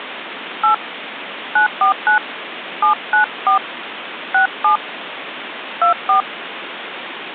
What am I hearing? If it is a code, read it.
DTMF, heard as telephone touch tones, dialled by hand, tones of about 110 ms, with phone line noise. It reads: 8 949 794 67 24